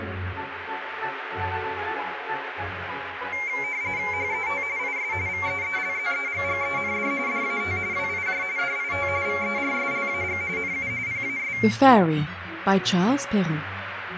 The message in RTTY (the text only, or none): HET IS VEELZEGGEND DAT WIJ DIT VERSLAG NU PAS